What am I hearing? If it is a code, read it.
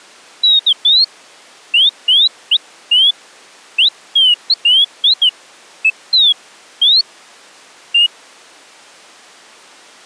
Bird-like chirps. There is no code.